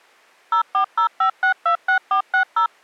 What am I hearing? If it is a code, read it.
DTMF, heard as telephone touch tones, dialled by machine, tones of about 100 ms. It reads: 0405626460